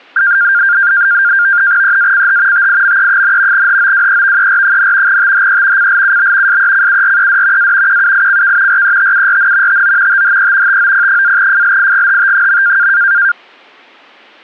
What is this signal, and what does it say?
NAVTEX (SITOR-B), 100 baud, 170 Hz shift, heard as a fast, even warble, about 1500 Hz centre. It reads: EACH TIME, HOWEVER, THE CLUB SECURED A QUICK RETURN TO THE TOP-FLIGHT.